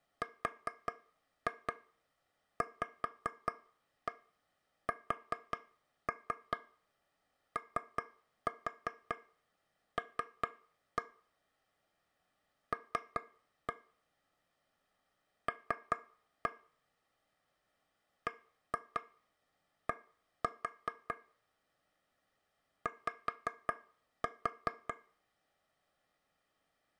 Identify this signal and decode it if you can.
Tap code, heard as taps on a table, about 5 knocks a second, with room echo. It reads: RVSOL L L BD Y